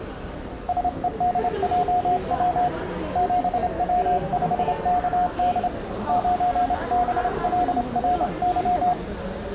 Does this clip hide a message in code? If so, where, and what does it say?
Yes: Morse code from 0.6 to 9.0 s, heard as a keyed tone, hand-sent with a straight key, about 27 wpm, 720 Hz, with the noise of a crowd indoors. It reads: SEDJW 7W5KD 9BLRY